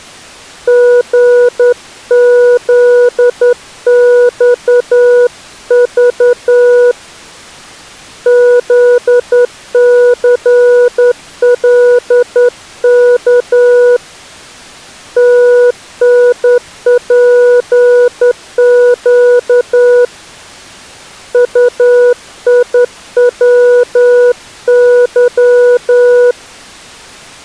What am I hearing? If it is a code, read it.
Morse code, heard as a keyed tone, hand-sent with a straight key, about 10 wpm, 490 Hz. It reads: GZXV ZCLK TNPQ UIWY